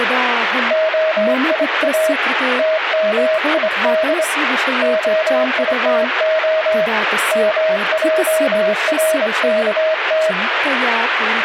Morse code (Hebrew alphabet), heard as a keyed tone, hand-sent with a straight key, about 25 wpm, 630 Hz, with radio static and speech in Sanskrit. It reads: היא תמיד היתה מערכת